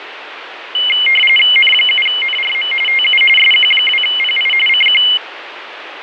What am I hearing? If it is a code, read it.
RTTY (45.45 baud, 850 Hz shift), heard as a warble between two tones, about 2550 Hz centre, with radio static. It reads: N7NRM TU SQ2PI CQ